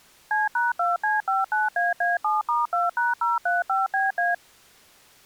DTMF, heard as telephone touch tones, dialled by machine, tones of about 170 ms. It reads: C#2C59AA7*2#035BA